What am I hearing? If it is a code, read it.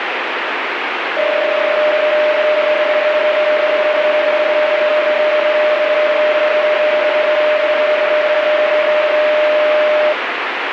PSK31 (31.25 baud), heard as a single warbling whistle, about 610 Hz, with radio static.